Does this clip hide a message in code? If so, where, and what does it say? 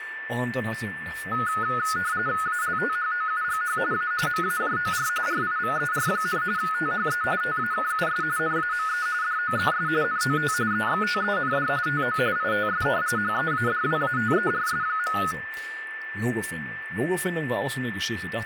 Yes: RTTY (45.45 baud, 170 Hz shift) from 1.3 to 15.3 s, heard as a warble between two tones, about 1360 Hz centre, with radio static, a steady whistle near 1770 Hz and speech in German. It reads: ALTHOUGH A MAJOR RIVER, THE TAKUS NAME DOES NOT EXTEND TO ITS HEADWATERS.